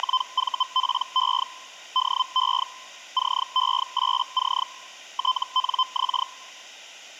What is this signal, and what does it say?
Hellschreiber (Feld-Hell, 122.5 baud), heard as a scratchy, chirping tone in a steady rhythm, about 1030 Hz. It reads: … DE CE8C TNX